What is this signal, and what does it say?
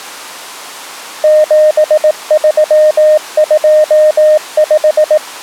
Morse code, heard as a keyed tone, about 18 wpm, 610 Hz. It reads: 7325